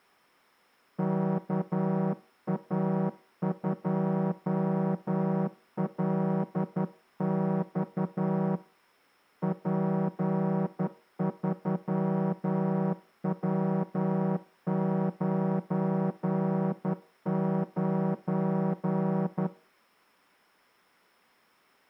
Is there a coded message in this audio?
Yes: Morse code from 0.9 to 19.5 s, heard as a horn, hand-sent with a straight key, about 11 wpm. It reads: KA2LX P3W99